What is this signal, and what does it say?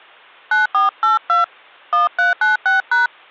DTMF, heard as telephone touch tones, dialled by hand, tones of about 150 ms, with hum. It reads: 9482 1396#